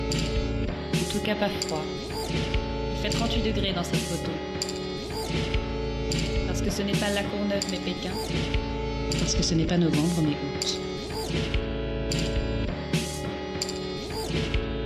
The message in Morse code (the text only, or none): none